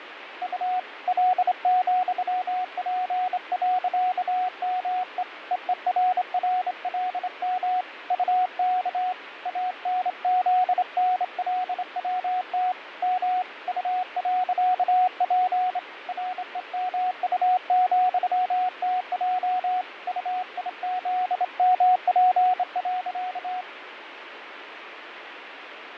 Morse code, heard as a keyed tone, hand-sent with a straight key, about 26 wpm, 730 Hz, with radio static and fading. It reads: U L,P.ME EERRLM UK ANZNLWT M U.P REMU,TJ UIZMP.